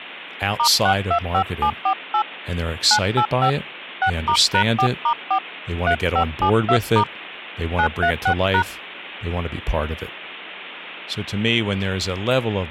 DTMF, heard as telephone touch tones, dialled by hand, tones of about 80 ms, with speech in English. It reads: *625748 985 6*#4*4 3572* 936#